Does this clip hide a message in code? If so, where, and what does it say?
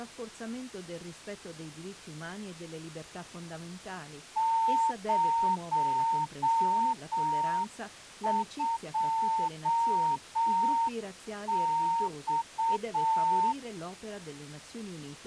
Yes: Morse code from 4.3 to 13.6 s, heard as a whistle, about 7 wpm, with speech in Italian. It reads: 02X